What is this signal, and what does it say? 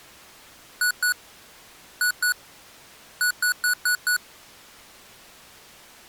Beep code, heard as beeps from a small speaker, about 1470 Hz. 2-2-5.